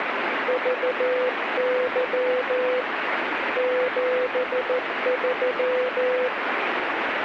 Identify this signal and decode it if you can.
Morse code, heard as a keyed tone, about 14 wpm, 500 Hz, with radio static. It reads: VY 73